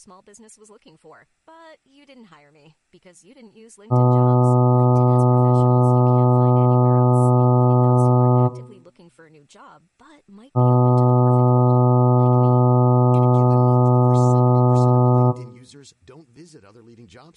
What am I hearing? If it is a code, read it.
Ship horn signal, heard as a ship's horn, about 120 Hz, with speech in English. 2 long. At sea: a vessel under power that has stopped in fog.